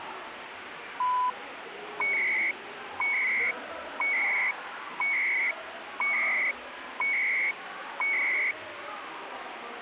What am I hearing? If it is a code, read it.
Radio time signal (CHU, Canada), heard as beeps and data bursts, one a second, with radio static and the noise of a crowd indoors.